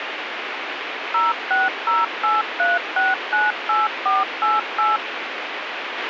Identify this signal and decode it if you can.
DTMF, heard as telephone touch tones, dialled by machine, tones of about 180 ms, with radio hiss and a squelch burst at the end. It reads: 06083698488